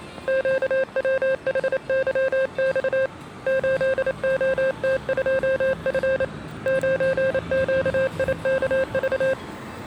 Morse code, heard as a keyed tone, hand-sent with a paddle, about 28 wpm, 530 Hz, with street noise. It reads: QWHYX 8OT2F 9QIKV